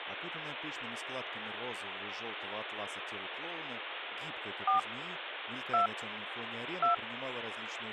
DTMF, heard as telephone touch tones, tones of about 120 ms, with phone line noise. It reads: 4 2 2